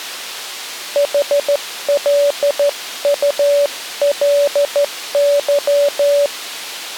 Morse code, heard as a keyed tone, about 13 wpm, 570 Hz. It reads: HLULY